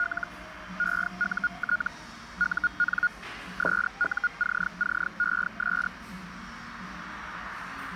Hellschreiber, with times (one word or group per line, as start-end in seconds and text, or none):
0.0-0.3 …
0.8-1.9 EUT
2.4-3.1 UN
3.6-5.9 SUCCES